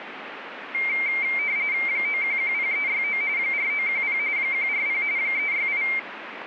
RTTY (45.45 baud, 170 Hz shift), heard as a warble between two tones, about 2200 Hz centre, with radio static. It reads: 9110369 4910 140 368